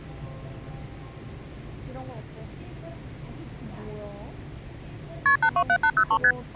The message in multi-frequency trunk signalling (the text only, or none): KP 827803 ST